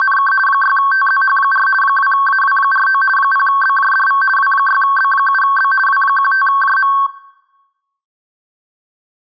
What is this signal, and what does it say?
RTTY (50 baud, 450 Hz shift), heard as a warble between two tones, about 1330 Hz centre. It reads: … 6TZH4 2AW49 0BJDV W6B7B W15JM